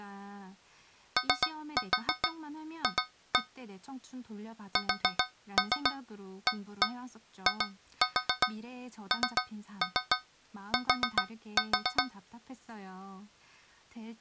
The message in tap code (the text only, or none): OF SAINT